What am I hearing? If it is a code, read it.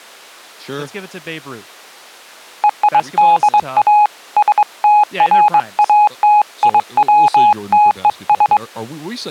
Morse code (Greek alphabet), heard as a keyed tone, hand-sent with a straight key, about 22 wpm, 840 Hz, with speech in English. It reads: ΕΙΔΑ ΣΤΡΑΤΙΩΤΕΣ